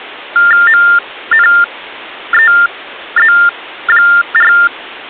TTY/TDD text telephone tones (45.45 baud Baudot), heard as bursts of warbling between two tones, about 400 Hz shift, 1600 Hz centre. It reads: MNEZ4